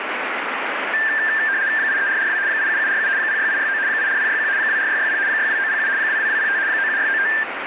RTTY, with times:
1.8-2.4 83442
2.5-3.1 87747
3.2-3.8 06869
3.9-4.5 84061
4.6-5.2 24660
5.3-5.9 62907
6.0-6.6 22205
6.7-7.3 97695

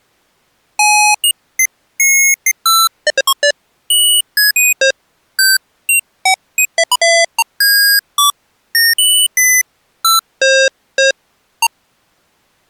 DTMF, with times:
none

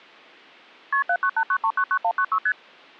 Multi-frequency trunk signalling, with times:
0.9-1.0 KP
1.1-2.4 7989399196
2.5-2.5 ST

